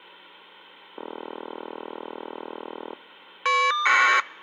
Caller ID data burst, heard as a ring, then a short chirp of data, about 1200 baud.